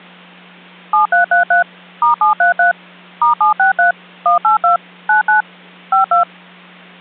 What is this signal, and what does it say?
DTMF, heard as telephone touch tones, dialled by machine, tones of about 120 ms, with hum. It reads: 7333 *733 *763 182 99 52